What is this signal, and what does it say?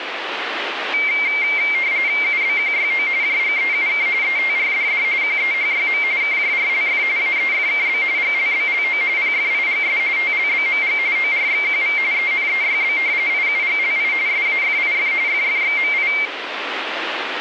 RTTY (45.45 baud, 170 Hz shift), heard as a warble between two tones, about 2200 Hz centre, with radio static. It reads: UBQYO JGEUK ETRDD QEHYM KJRLF AEFKB GLBLO PFIGS TLBMG ORXQV ENEYB IUGLI SAFIF FFXMI